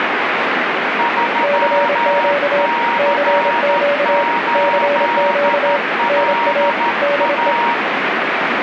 Morse code, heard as two keyed tones, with radio static. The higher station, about 13 wpm, 940 Hz: 3C8LA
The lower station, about 26 wpm, 570 Hz: CQ CQ CQ NA DE